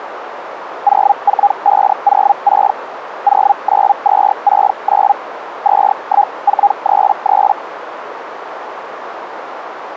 Hellschreiber (Feld-Hell, 122.5 baud), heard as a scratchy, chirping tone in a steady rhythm, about 810 Hz, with radio static and a narrow filter. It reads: 04506 09269 21433